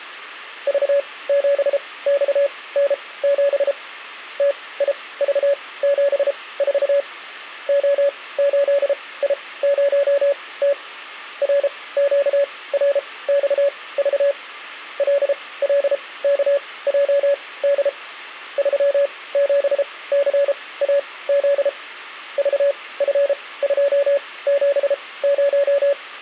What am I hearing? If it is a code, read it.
Morse code, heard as a keyed tone, machine-sent, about 33 wpm, spaced as for 20 wpm, 560 Hz. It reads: V7XN7 TIV74 O8I0T RQRXV LLKJD 37CAZ VF270